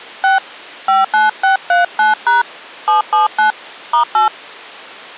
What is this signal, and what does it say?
DTMF, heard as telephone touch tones, dialled by hand, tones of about 140 ms. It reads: 6 59639# 779 *8